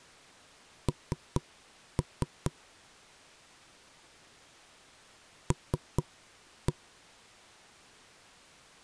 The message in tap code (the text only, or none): N L